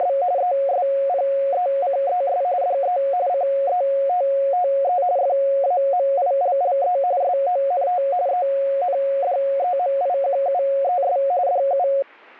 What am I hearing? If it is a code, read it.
RTTY (45.45 baud, 170 Hz shift), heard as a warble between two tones, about 640 Hz centre. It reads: … ESPECES DE CETTE FAMILLE SONT ENDEMIQUES DU